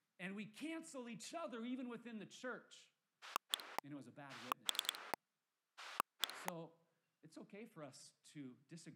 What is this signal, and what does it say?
Pulse dialling, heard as a rotary dial, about 10 pulses a second, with speech in English. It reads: 1 3 1